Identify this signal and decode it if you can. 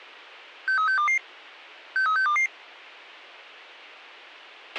Five-tone selective call (CCIR), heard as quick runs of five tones, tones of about 100 ms, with a squelch burst at the end. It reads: 63622 63622